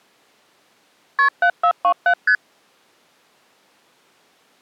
Multi-frequency trunk signalling (R1, as on North American trunks), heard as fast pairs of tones, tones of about 80 ms. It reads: KP 7427 ST